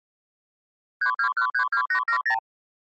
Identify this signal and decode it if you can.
Multi-frequency trunk signalling (R2, with the far end's replies), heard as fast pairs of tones, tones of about 90 ms. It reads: 32132870